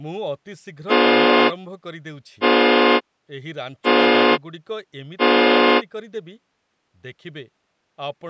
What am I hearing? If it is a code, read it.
Train horn signal, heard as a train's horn, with speech in Odia. 4 short. On North American railways: a request for a signal to be given or repeated.